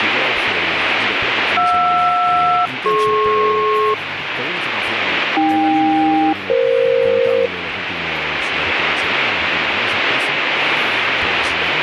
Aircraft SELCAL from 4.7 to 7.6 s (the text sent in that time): AK-EF